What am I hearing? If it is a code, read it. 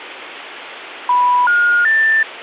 Telephone call progress tone (North American plan), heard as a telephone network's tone, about 980, 1430, 1800 Hz, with phone line noise. Special information tone.